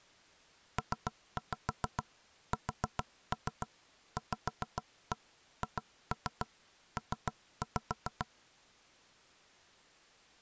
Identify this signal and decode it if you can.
Tap code, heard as knocks on wood, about 7 knocks a second. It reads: PSVHP